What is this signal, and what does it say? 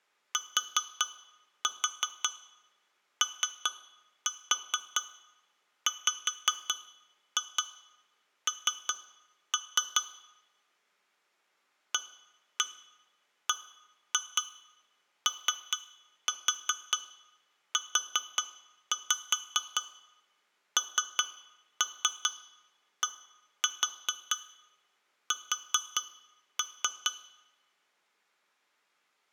Tap code, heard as taps on glass, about 4 knocks a second, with room echo. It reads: TOWN ABOUNDS